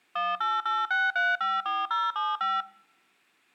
DTMF, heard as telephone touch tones, dialled by machine, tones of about 200 ms, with room echo. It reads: 1886354075